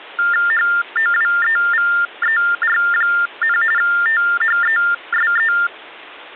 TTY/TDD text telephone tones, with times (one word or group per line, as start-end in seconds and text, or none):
0.5-3.6 HOWEVER,
3.8-5.5 THESE